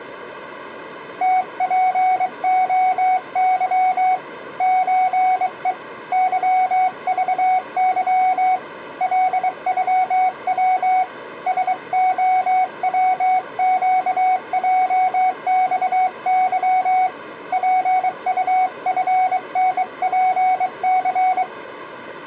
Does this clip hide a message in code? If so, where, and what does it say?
Yes: Morse code (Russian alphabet) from 1.2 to 21.5 s, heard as a keyed tone, hand-sent with a bug key, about 23 wpm, 740 Hz. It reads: ТПОЫ ЧЕ ЫЖЫ ЛЮВ СОВЩЙЬЫ ПУФНПЦ